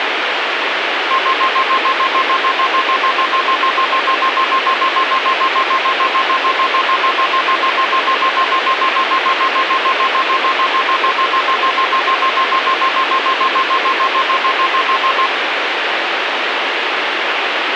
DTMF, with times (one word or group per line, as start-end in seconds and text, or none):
none